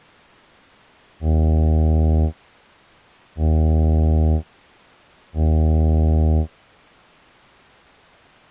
Ship horn signal, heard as a ship's horn, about 80 Hz. 3 short. At sea: I am operating astern propulsion.